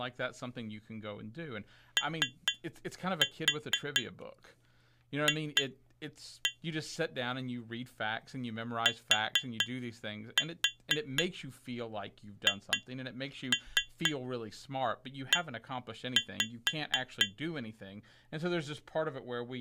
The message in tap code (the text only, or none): OF THE